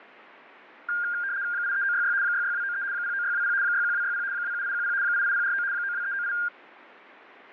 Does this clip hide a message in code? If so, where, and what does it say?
Yes: RTTY (75 baud, 170 Hz shift) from 0.9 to 6.5 s, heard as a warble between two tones, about 1500 Hz centre. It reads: 83966 66293 09620 61260 27810 88049 92398